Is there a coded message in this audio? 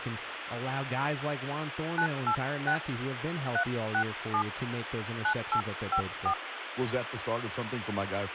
Yes: DTMF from 2.0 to 6.3 s, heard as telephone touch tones, dialled by hand, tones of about 80 ms, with phone line noise and speech in English. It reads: 986 367 9854